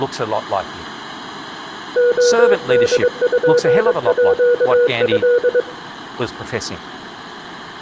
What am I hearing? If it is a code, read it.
Morse code (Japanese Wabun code), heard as a keyed tone, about 22 wpm, 480 Hz, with room echo and speech in English. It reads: レポート